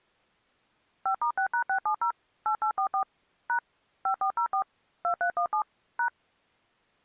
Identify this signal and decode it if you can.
DTMF, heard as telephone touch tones, dialled by machine, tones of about 90 ms. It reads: 5*6#670 8844 # 5404 2317 #